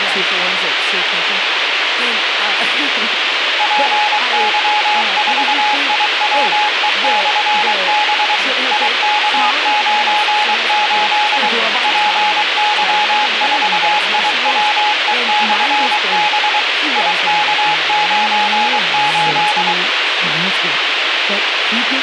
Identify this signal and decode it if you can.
Morse code, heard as a keyed tone, machine-sent, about 23 wpm, 840 Hz, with radio hiss and speech in English. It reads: PY4IWE/B IK98 PY4IWE/B IK98